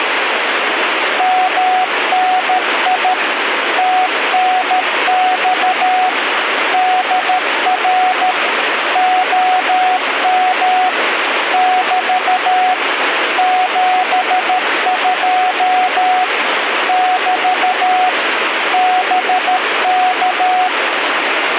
Morse code, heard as a keyed tone, machine-sent, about 13 wpm, 740 Hz, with radio static. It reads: MNI TNX DR OM <BT> 72 <BT> BK